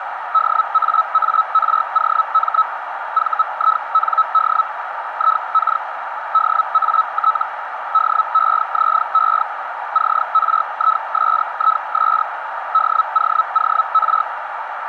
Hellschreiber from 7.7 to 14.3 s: DEZE CRISIS DOOR

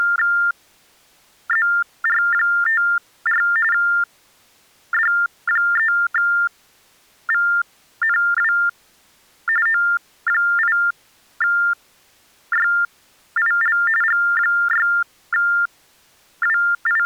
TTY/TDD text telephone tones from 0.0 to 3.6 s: …

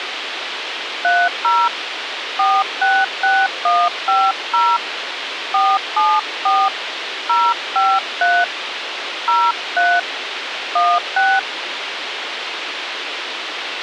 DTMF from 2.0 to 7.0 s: 466150 474

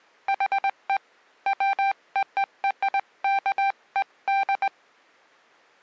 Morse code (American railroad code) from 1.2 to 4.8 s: WORKED

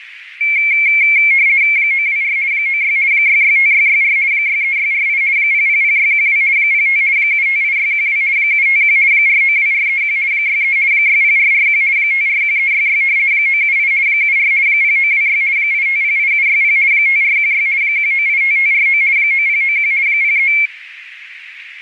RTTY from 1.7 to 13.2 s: 924 96 665664 63648 000612 05 758612 751 492431 63 60441 541366

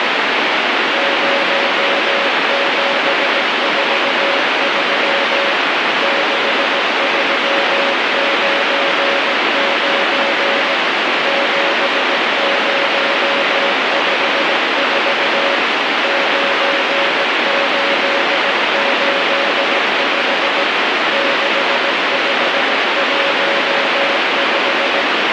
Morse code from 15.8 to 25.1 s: 9885 6515

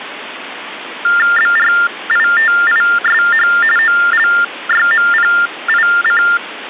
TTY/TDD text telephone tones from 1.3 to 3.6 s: BRITISH

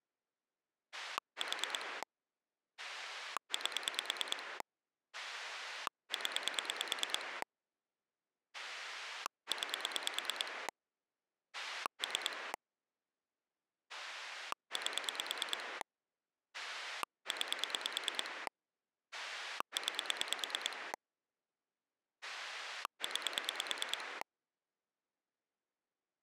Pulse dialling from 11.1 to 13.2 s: 3

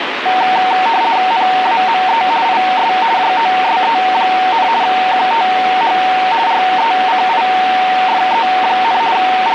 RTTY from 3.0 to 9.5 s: JOSE, QTH RECIFE, …

